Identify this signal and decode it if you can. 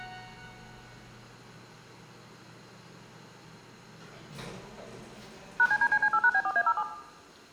DTMF, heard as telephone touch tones, dialled by machine, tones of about 60 ms, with the noise inside a lift. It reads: #CDCC8#B4A07